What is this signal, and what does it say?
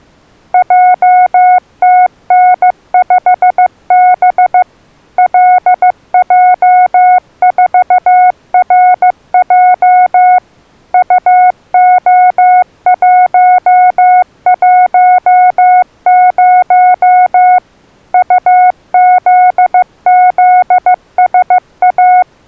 Morse code, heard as a keyed tone, machine-sent, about 15 wpm, 730 Hz. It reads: JTN5B LJ4RJ UO110 UZZSA